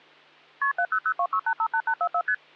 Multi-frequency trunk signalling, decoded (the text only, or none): KP 70026858844 ST